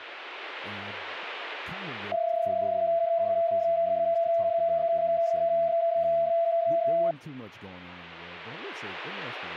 PSK31 (31.25 baud), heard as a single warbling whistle, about 670 Hz, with speech in English.